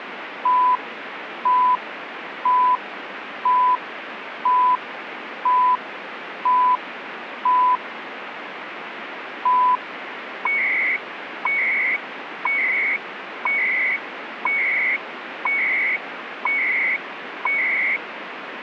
Radio time signal (CHU, Canada), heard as beeps and data bursts, one a second, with radio static.